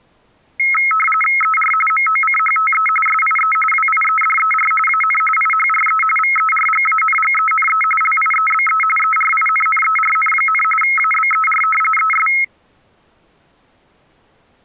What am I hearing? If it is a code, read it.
RTTY (45.45 baud, 850 Hz shift), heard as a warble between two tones, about 1700 Hz centre. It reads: ER MOCHTE SIE WIEDER AN IHRE VERGANGENE LIEBE ERINNERN, ABER ES